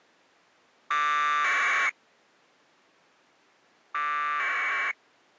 Packet radio (AX.25, as in APRS), 1200 baud, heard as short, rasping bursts.